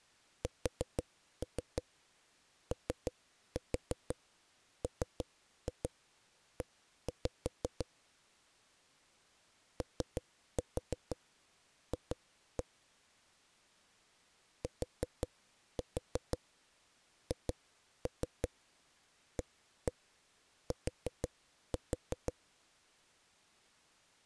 Tap code, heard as knocks on a wall, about 6 knocks a second. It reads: SOME OF THAT